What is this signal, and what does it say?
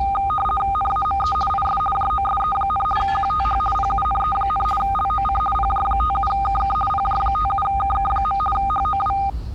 RTTY (50 baud, 450 Hz shift), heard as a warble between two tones, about 1010 Hz centre, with the noise of a park. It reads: NAME IS JOSE, QTH PUNE, LOC PJ57KK PJ57KK. HOW